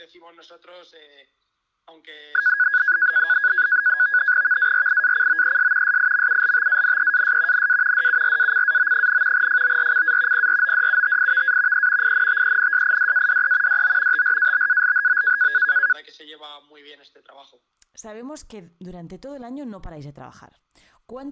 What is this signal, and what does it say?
NAVTEX (SITOR-B), 100 baud, 170 Hz shift, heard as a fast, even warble, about 1550 Hz centre. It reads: VARIACOES SIMULTANEAS NA DURACAO, FORCA PRODUTIVA E INTENSIDADE DO TRABALHO